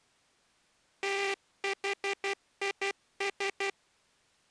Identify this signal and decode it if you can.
Morse code, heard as a buzzer, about 12 wpm. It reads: THIS